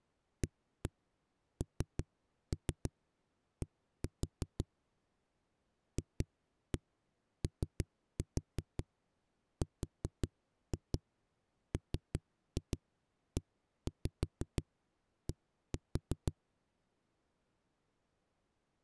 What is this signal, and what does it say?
Tap code, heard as knocks on a wall, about 5 knocks a second. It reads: AND FORMED